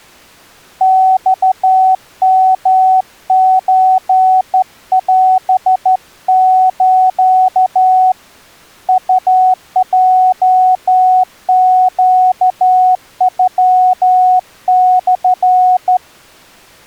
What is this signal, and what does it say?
Morse code (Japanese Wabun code), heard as a keyed tone, hand-sent with a straight key, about 13 wpm, 740 Hz. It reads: マヨソオス ウヲネノモ